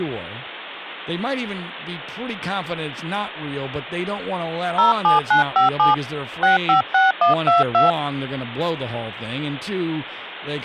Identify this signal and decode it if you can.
DTMF, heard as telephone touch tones, dialled by hand, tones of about 140 ms, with speech in English. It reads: 07957 656122